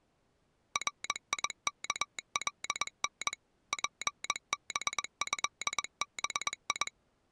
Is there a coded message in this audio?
Yes: Morse code (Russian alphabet) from 0.7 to 6.9 s, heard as a telegraph sounder, machine-sent, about 21 wpm. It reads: РИКЛН ПБЭБИ